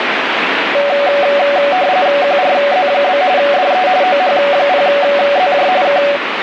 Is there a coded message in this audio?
Yes: RTTY (45.45 baud, 170 Hz shift) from 0.7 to 6.2 s, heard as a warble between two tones, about 660 Hz centre, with radio static. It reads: QRZ? DE OH0ZJ K